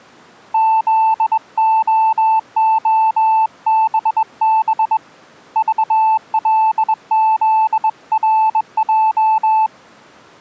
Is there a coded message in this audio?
Yes: Morse code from 0.5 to 9.7 s, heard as a keyed tone, hand-sent with a straight key, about 21 wpm, 880 Hz. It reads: ZOOBB VLZRJ